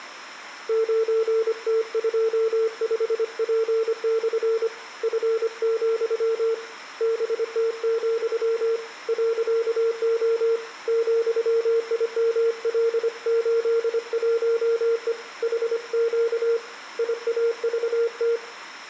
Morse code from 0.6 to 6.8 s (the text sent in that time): 9T25P/ F,